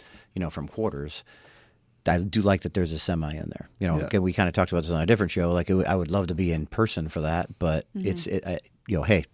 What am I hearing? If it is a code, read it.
Speech in English. There is no code.